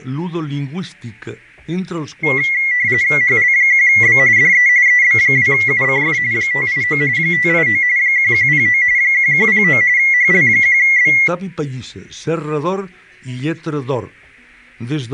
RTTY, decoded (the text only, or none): HL1B DE EB2UCF 589 589 1109 1109 HL1B